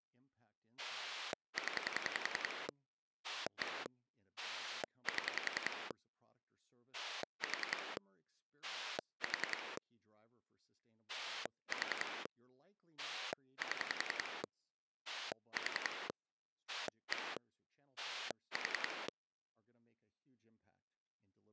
Pulse dialling, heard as a rotary dial, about 10 pulses a second, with speech in English. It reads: 0 1 7 4 4 4 7 4 1 4